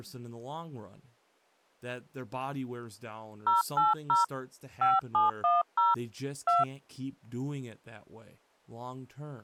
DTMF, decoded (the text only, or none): 080 5710 2